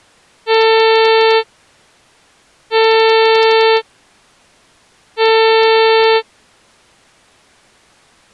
Ship horn signal, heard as a ship's horn, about 450 Hz. 3 short. At sea: I am operating astern propulsion.